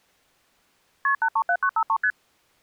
Multi-frequency trunk signalling (R1, as on North American trunks), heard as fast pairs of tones, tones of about 70 ms. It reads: KP 837953 ST